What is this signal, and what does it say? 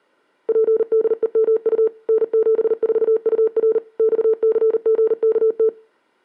Morse code, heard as a keyed tone, machine-sent, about 39 wpm, 440 Hz. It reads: PDEMU N74UR XCGKT